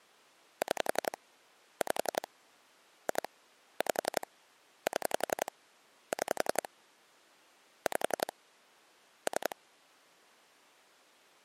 Pulse dialling, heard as clicks on a phone line, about 11 pulses a second. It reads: 6 5 2 5 7 6 5 3